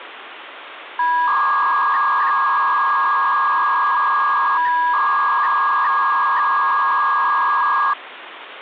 300-baud modem data (V.21 tones), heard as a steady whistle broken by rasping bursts, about 300 baud, 200 Hz shift, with phone line noise.